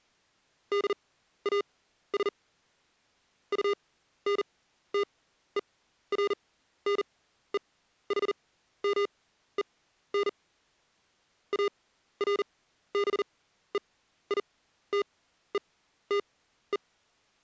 Morse code, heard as electronic beeps, machine-sent, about 40 wpm, spaced as for 14 wpm, 400 Hz. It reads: DAS UNTERNEHMEN ARBEITETE